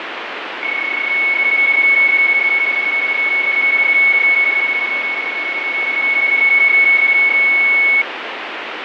PSK31 (31.25 baud), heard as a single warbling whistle, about 2200 Hz, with radio static and fading.